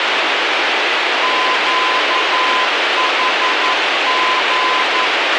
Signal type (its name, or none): Morse code